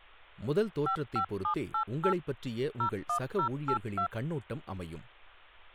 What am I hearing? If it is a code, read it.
DTMF, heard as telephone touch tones, dialled by machine, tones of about 90 ms, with speech in Tamil. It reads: 55788 01082